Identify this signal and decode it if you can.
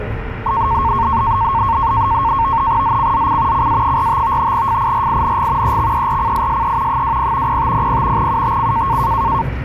NAVTEX (SITOR-B), 100 baud, 170 Hz shift, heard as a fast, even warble, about 1000 Hz centre, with radio static and the noise inside a bus. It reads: ZCZC CA45 FIRING EXERCISE 20 0500 UTC